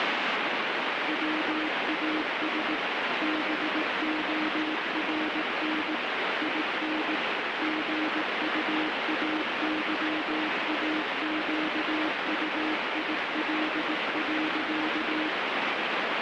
Morse code, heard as a keyed tone, machine-sent, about 18 wpm, 310 Hz, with heavy radio static. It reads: WAS BORN IN GUAYAQUIL.